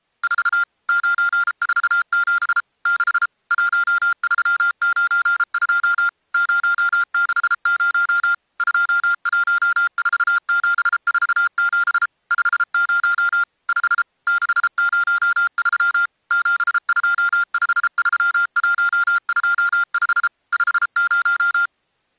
Morse code, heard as electronic beeps, machine-sent, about 33 wpm, 1400 Hz. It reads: 4 947 6 1392 060 214747 50 5 603 7253125 50